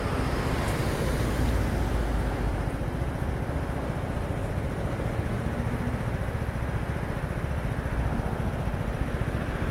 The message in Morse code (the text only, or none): none